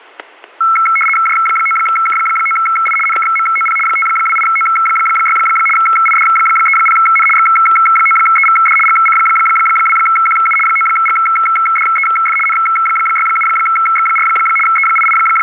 RTTY (75 baud, 850 Hz shift), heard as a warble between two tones, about 1750 Hz centre, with static crashes. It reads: J9K9I NKMOP 528O6 ID30N X9EVD GC2QU 9GDEF N67X4 …